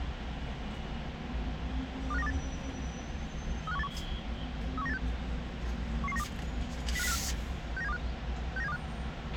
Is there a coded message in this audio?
Yes: five-tone selective call (EEA) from 2.1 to 8.8 s, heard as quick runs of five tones, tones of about 40 ms, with radio hiss, a squelch burst at the end and the noise of a residential street. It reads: 25928 35181 31986 11192 05054 69725 69725